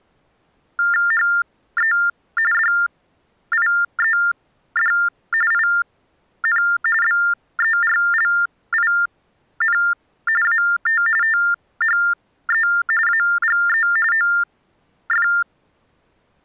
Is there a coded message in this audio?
Yes: TTY/TDD text telephone tones (45.45 baud Baudot) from 0.8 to 15.4 s, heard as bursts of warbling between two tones, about 400 Hz shift, 1600 Hz centre. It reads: HE DIED IN BERLIN AT THE AGE OF